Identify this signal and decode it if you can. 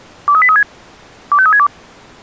Five-tone selective call (ZVEI), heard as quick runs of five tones, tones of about 70 ms. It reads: 23836 25362